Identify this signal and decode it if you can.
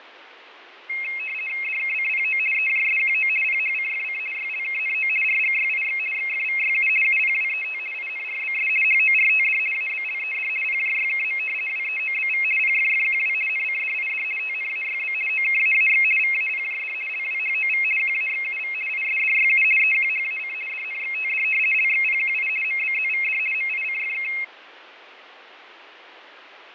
RTTY (50 baud, 450 Hz shift), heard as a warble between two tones, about 2350 Hz centre, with radio static and fading. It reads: DKCPO EJSQO PHCFC YLKNO RGYIX XFVYU UPWET INRBS HORTD ABLED PJYKM WEOBV PFFQW NCDID TNAYB OKAAX VAPJD LWHOV QAXUV ISDYU EQHAC DNXTD LXPQI MBZVD MICFK